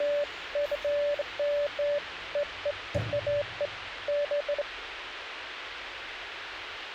Beeps of irregular length, with radio hiss and the noise inside a lift. There is no code.